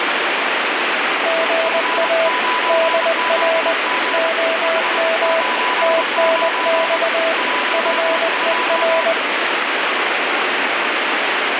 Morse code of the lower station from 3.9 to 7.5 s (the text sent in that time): OM TNX